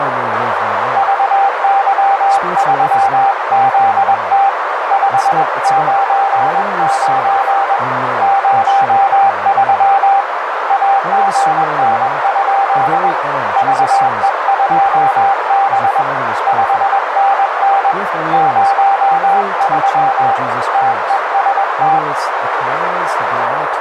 Morse code, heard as a keyed tone, hand-sent with a paddle, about 21 wpm, 790 Hz, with heavy radio static, a narrow filter and speech in English. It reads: VY3ZT 599 03 AGN? VE2B 5NN 03 TEST